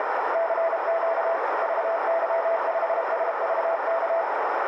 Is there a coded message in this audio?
Yes: Morse code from 0.3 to 4.3 s, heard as a keyed tone, machine-sent, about 32 wpm, 660 Hz, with heavy radio static and a narrow filter. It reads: CQ VY5SVK